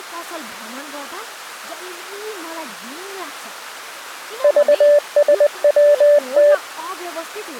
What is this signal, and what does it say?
Morse code, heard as a keyed tone, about 20 wpm, 580 Hz, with speech in Nepali. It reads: VSWT